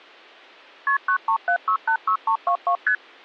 Multi-frequency trunk signalling (R1, as on North American trunks), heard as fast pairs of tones, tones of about 80 ms. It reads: KP 937686322 ST